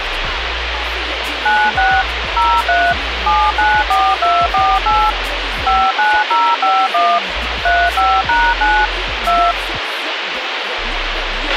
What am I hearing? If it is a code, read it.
DTMF, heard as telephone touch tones, dialled by machine, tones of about 250 ms, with radio hiss and a squelch burst at the end. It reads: 96 03 794248 59051 35#9 2